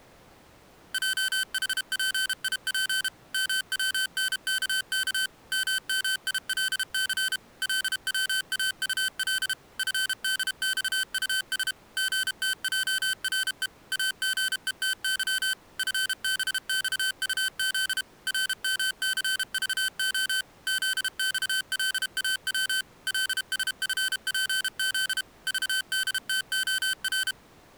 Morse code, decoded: JHPIP MWNKK MMILC LWAUL FDXUS GTJRE AGETY FBXUZ RMCVO ZXLAW LSFPZ VDTOR

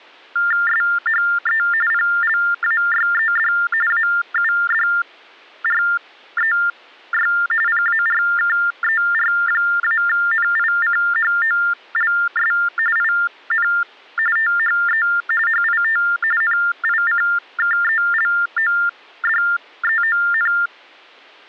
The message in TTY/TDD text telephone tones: SHE PLAYED AUDREY PARKER-NICHOLS IN THE HIT NICKELODEON

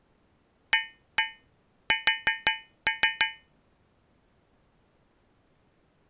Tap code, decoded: AS

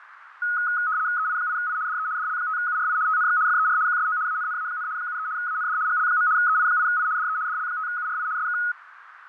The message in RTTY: EI8I DE DL5URI TNX FER QSO ANNA, 73 AND GL. EI8I DE DL5URI SK

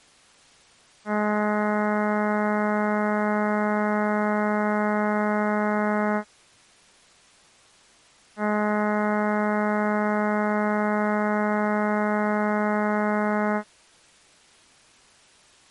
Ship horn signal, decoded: 2 long

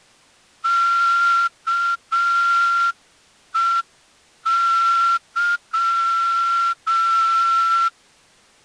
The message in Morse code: KEY

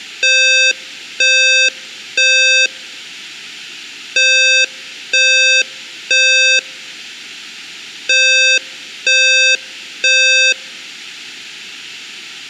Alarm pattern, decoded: temporal three

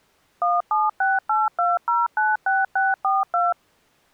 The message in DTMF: 17682096642

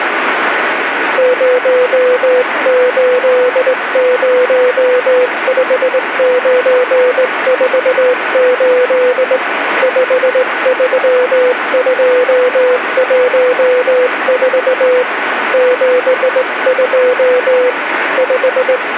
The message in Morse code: 0805948 53214 72 …

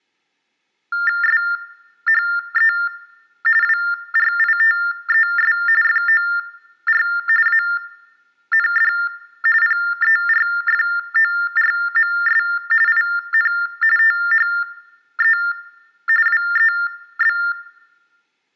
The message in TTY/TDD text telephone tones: SHE WRITES FOR AND PERFORMS IN THE WEB

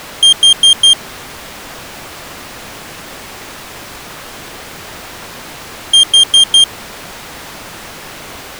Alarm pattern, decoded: temporal four

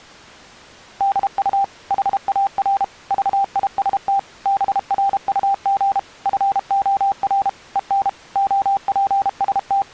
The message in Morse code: DU HAR VIST BRUG FOR EN …

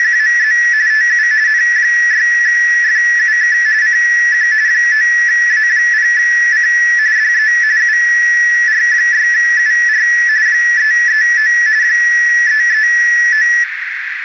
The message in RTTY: … TU N6FUK CQ 9A0C DE UR6UR 339 339

